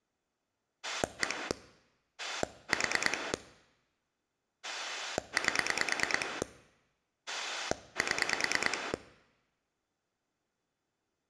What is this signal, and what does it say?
Pulse dialling, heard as a rotary dial, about 9 pulses a second. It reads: 1 4 8 7